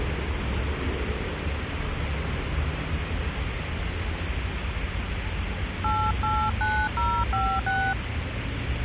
DTMF, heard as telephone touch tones, dialled by hand, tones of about 270 ms, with phone line noise and street noise. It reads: 889056